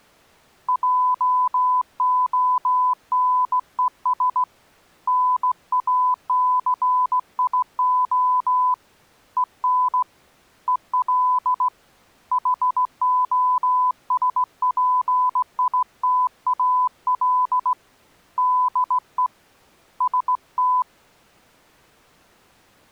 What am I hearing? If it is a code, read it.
Morse code, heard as a keyed tone, hand-sent with a straight key, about 17 wpm, 1000 Hz. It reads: JONES NACIO EN EL HOSPITAL DE ST